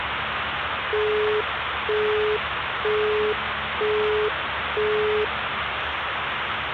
Telephone call progress tone (single-tone plan, as in Europe, Japan and elsewhere), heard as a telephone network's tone, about 420 Hz, 0.48 s on and 0.48 s off, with phone line noise and the noise inside a bus. Busy tone.